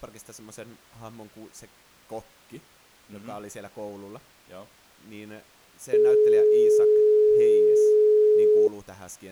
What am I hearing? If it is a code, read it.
Telephone call progress tone (425 Hz plan, as in most of Europe), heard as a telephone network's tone, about 420 Hz, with speech in Finnish. Dial tone.